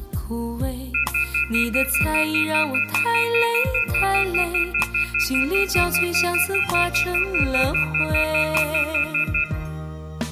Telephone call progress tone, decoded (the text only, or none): off-hook warning tone